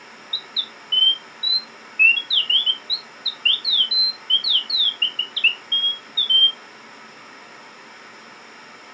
Bird-like chirps. There is no code.